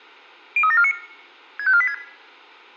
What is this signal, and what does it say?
Five-tone selective call (ZVEI), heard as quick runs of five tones, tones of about 70 ms, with room echo. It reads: 03749 65486